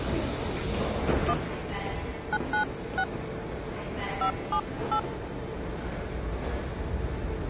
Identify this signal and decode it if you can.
DTMF, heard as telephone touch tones, dialled by hand, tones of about 80 ms, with the noise of a subway station. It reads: 1 996 578